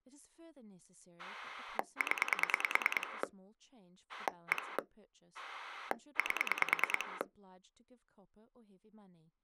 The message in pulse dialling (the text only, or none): 0 1 8